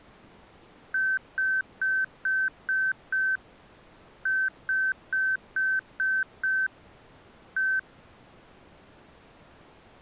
Beep code, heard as beeps from a small speaker, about 1550 Hz. 6-6-1.